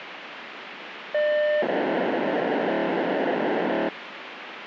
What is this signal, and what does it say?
POCSAG pager data (1200 baud), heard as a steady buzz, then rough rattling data, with radio hiss.